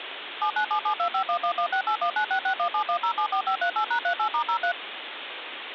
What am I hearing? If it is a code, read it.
DTMF, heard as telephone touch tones, dialled by machine, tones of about 90 ms, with phone line noise. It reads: 797725111681966171074538#38*03